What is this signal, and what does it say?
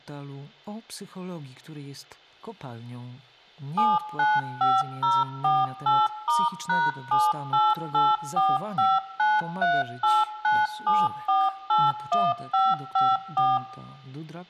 DTMF, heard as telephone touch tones, dialled by machine, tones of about 210 ms, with room echo. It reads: 795048*#7884593897481554